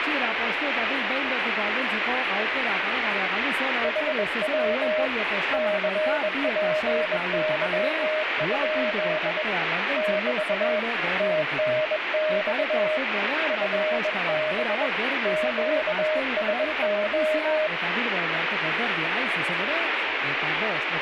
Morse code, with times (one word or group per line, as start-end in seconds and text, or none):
3.8-5.1 HW
5.5-9.4 CPY?
10.0-10.8 <BT>
11.2-13.0 TNX
13.5-14.9 FB
15.3-17.7 QSO